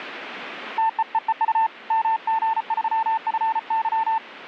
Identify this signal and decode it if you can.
Morse code, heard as a keyed tone, hand-sent with a paddle, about 34 wpm, 890 Hz. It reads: TEEEU MG3FY